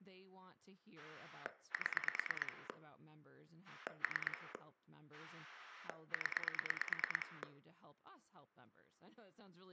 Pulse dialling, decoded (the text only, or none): 7 3 0